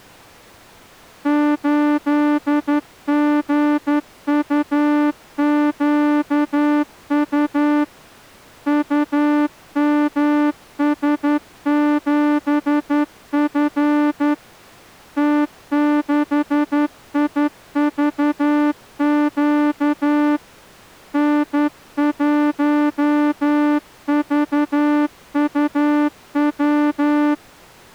Morse code, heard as a horn, hand-sent with a straight key, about 11 wpm. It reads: 8GUQU UMS7F T6IVQ N1VUW